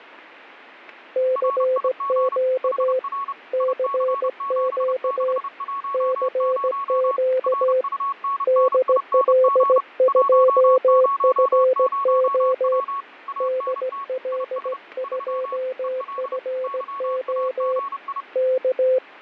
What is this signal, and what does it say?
Morse code, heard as two keyed tones, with radio static and fading. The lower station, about 17 wpm, 520 Hz: CQ CQ CQ DL2FO DL2FO K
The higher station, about 30 wpm, 1110 Hz: RIG HR IC7610 RUNNING 100W ANT IS 3 EL YAGI